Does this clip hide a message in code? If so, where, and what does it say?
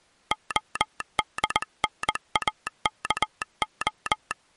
Yes: Morse code (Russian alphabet) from 0.3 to 4.4 s, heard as a telegraph sounder, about 20 wpm. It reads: ОДНАКО